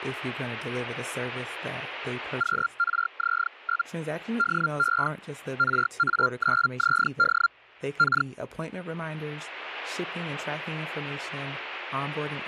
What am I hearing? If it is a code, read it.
Hellschreiber (Feld-Hell, 122.5 baud), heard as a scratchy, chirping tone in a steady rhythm, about 1390 Hz, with speech in English. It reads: QRZ? DE RA9ZD K